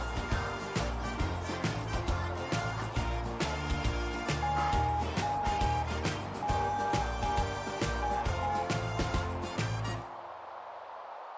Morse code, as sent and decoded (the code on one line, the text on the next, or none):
-- -. ..
MNI